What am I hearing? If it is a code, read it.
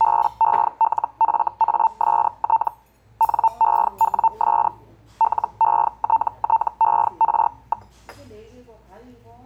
Hellschreiber (Feld-Hell, 122.5 baud), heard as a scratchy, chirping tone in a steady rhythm, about 900 Hz, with the noise of a restaurant. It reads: BELFAST NEWS LETTER.